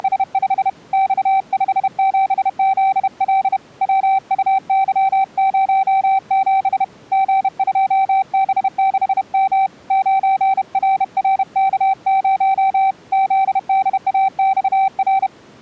Morse code, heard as a keyed tone, hand-sent with a bug key, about 31 wpm, 770 Hz. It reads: … X57ZL WUY07 G2B6M 9RRK0 ZDAXR